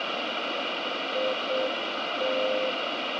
Morse code, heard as a keyed tone, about 7 wpm, 520 Hz, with heavy radio static. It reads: IT